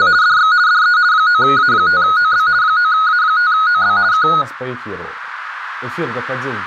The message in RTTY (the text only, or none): … DX DE 9A5OB 9A5OB K